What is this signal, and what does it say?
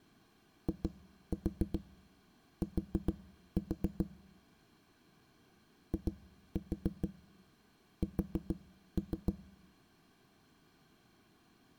Tap code, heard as knocks on a wall, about 6 knocks a second. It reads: IT IS